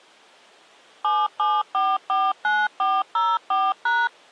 DTMF, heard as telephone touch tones, dialled by machine, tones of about 220 ms. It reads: 77449404#